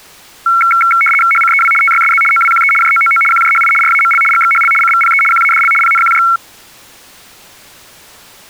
RTTY (75 baud, 850 Hz shift), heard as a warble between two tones, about 1800 Hz centre. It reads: HCEW TYSZ OWQE JOOO QJHI RAML GXHL CVPE QADL PNQJ